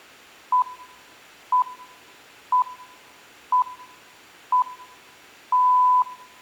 Radio time signal (six pips, as the Greenwich Time Signal), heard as pips, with room echo.